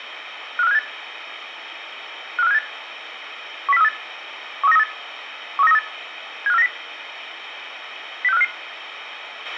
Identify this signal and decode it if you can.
Five-tone selective call (EEA), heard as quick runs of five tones, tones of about 40 ms, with radio hiss, a squelch burst at the end and room echo. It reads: 54578 54578 10438 13938 13938 75490 06455